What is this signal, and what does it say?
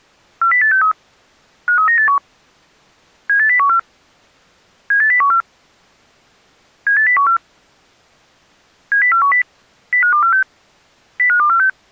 Five-tone selective call (CCIR), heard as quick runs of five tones, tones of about 100 ms. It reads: 40863 53981 78014 78014 78014 70410 05246 05246